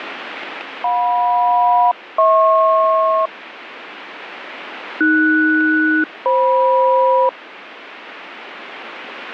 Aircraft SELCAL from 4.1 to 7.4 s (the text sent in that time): AS-FM